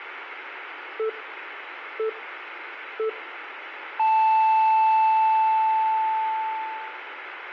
Radio time signal (three low pips and a long one an octave up, as on NHK), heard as pips, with radio static and room echo.